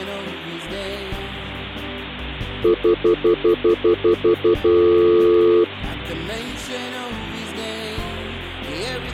Telephone call progress tone (North American plan), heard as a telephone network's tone, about 350, 440 Hz, 0.1 s on and 0.1 s off. Stutter dial tone.